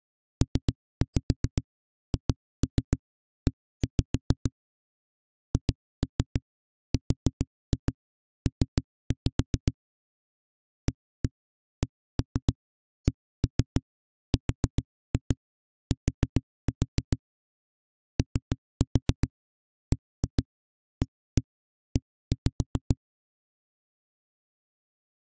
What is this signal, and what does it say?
Tap code, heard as knocks on a wall, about 7 knocks a second. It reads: PHE HRP ACCRT OBAE